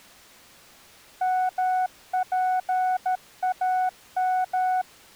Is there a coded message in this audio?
Yes: Morse code (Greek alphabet) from 1.2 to 4.9 s, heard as a keyed tone, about 13 wpm, 740 Hz. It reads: ΜΠΑΜ